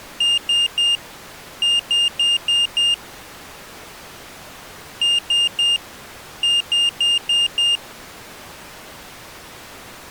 Beep code, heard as a piezo beeper, played twice, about 2800 Hz. 3-5.